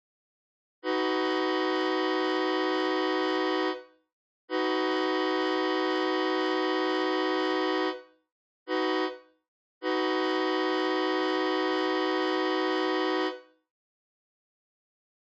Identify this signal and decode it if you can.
Train horn signal, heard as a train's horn, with room echo. 2 long, 1 short, 1 long. On North American railways: approaching a public crossing.